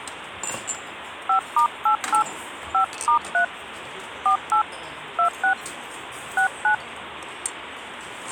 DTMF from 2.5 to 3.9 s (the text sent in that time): 5*3